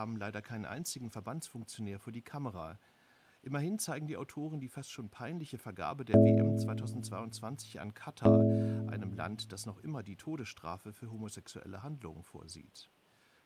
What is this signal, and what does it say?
Clock strike, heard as a bell, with speech in German. 2. Two o'clock.